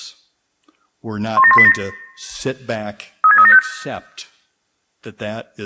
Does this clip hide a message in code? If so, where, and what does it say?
Yes: five-tone selective call (ZVEI) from 1.4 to 3.6 s, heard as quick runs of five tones, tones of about 70 ms, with room echo. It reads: 17187 36375